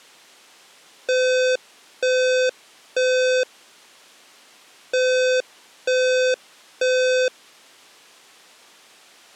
Alarm pattern, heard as an alarm's beeps, played twice, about 510 Hz. Temporal three. Smoke or fire, evacuate.